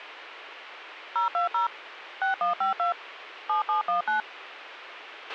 DTMF, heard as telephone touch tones, dialled by machine, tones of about 130 ms, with radio hiss and a squelch burst at the end. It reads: 020 6152 7719